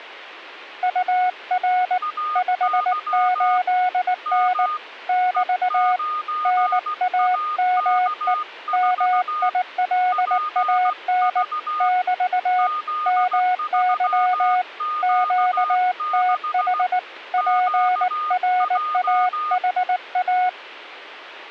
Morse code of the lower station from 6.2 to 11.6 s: NAME MILAN

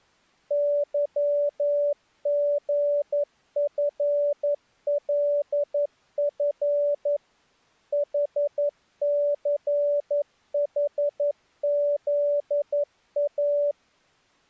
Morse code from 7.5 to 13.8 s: HCHZA

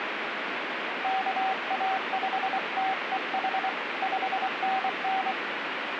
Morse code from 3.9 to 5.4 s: 5NN

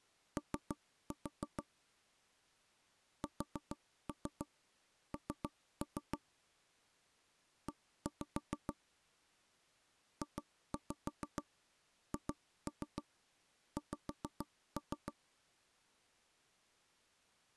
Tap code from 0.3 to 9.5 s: O SN E

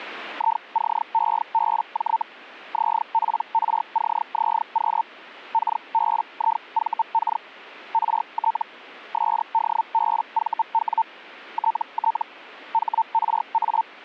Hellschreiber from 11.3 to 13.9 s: TT HRA

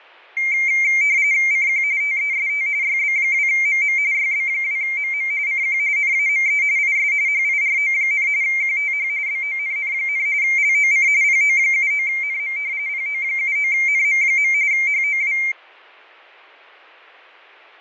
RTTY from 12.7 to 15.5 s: PO79NM. HOW

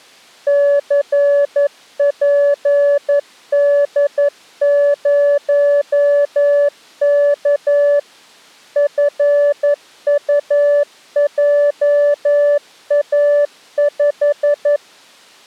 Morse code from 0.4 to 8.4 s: CPD0K

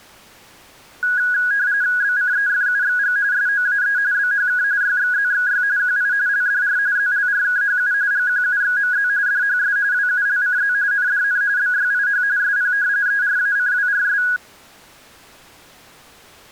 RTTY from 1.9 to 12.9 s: BCEFUXG SOAE BHK YXZXY QI LDR ZLRKHU GQUXMZ DHS WULCZ NDN BYIH SP

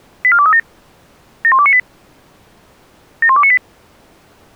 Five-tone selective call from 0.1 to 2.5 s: 84237 71298

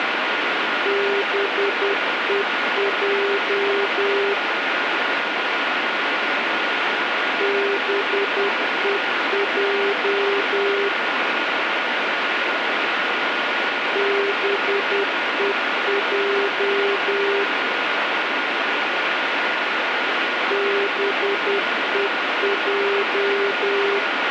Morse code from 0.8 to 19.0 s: BEJ BEJ BEJ

